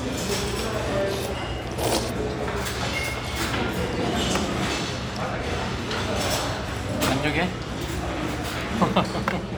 The noise of a restaurant. There is no code.